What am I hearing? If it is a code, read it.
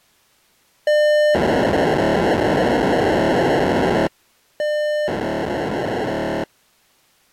POCSAG pager data (1200 baud), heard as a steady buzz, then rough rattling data.